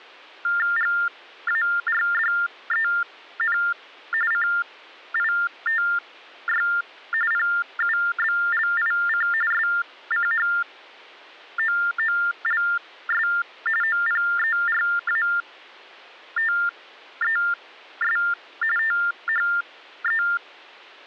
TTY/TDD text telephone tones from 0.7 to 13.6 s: GARDEN CITY PUBLIC SCHOOLS

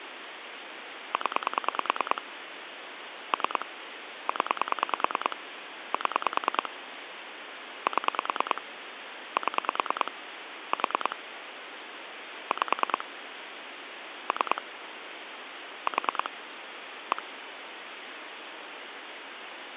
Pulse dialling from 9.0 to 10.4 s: 7

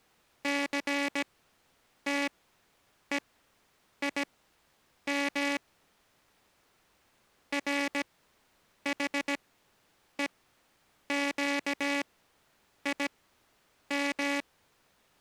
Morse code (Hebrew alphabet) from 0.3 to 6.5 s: סתוים

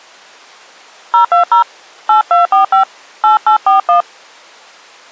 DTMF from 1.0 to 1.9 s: 020

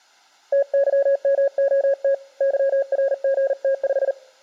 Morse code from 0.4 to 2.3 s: TYMOT

